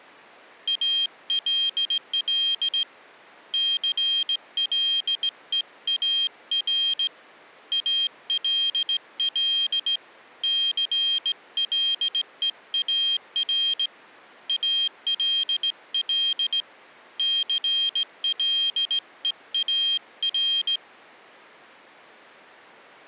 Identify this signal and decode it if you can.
Morse code, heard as a high beeper, hand-sent with a straight key, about 17 wpm, 3200 Hz. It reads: ALL CLEAR ALL CLEAR ALL CLEAR